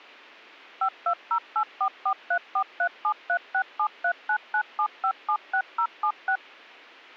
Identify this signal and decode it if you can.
DTMF, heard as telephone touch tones, dialled by machine, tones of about 80 ms. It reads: 52084434373673997576076